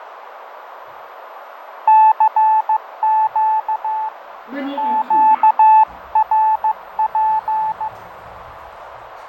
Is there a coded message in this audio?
Yes: Morse code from 1.8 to 7.9 s, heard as a keyed tone, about 15 wpm, 870 Hz, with radio static, fading, a narrow filter and the noise inside a lift. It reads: CQ QRP